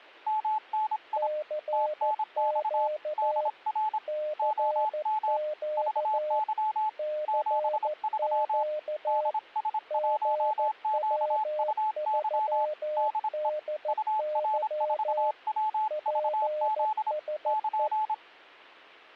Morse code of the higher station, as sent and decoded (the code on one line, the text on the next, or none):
-- -. .. / - -. -..- / -.. .-. / --- -- / ...- -.-- / --... ...-- / -.. ... .---- --.- ..- -.-- / -.. . / ..- .-. ....- .-- ...- --.. / -.--.
MNI TNX DR OM VY 73 DS1QUY DE UR4WVZ <KN>